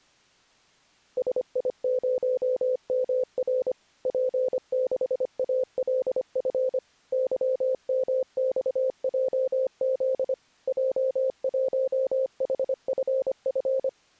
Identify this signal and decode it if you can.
Morse code, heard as a keyed tone, machine-sent, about 25 wpm, 520 Hz. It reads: SI0MR P6ALF YMXJZ J1HFF